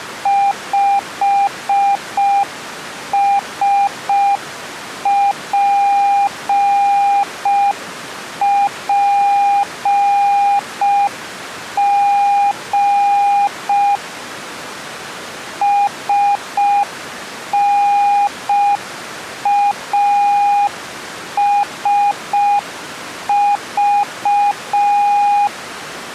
Morse code, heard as a keyed tone, machine-sent, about 5 wpm, 810 Hz. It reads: 5SPPG SNASV